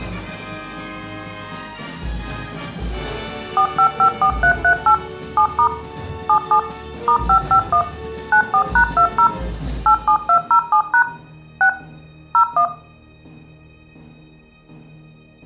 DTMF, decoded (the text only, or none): 4554338 7* 77 *551 94#20 87207# 6 01